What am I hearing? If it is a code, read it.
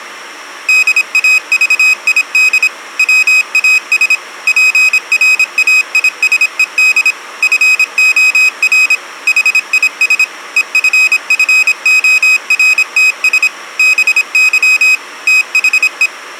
Morse code, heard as a high beeper, machine-sent, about 26 wpm, 2500 Hz. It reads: DAVID WAS PRAISED FOR HIS EFFORTS BY THE